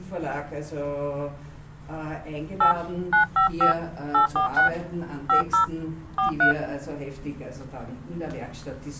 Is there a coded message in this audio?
Yes: DTMF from 2.6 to 6.5 s, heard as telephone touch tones, dialled by hand, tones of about 110 ms. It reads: 8 955 846 50 43